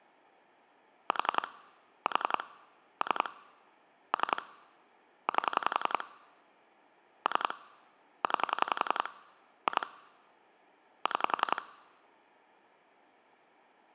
Pulse dialling, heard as clicks on a phone line, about 11 pulses a second. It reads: 4 4 3 3 8 3 9 2 6